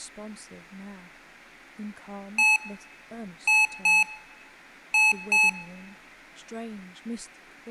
Beep code, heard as beeps from a small speaker, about 860 Hz, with room echo and speech in English. 1-2-2. In Phoenix BIOS tables: DMA initialisation failure.